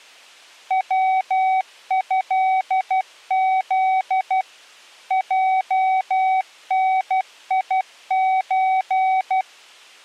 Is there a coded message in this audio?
Yes: Morse code (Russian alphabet) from 0.6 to 9.5 s, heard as a keyed tone, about 12 wpm, 760 Hz. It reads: ВЭЗ ЙНИЧ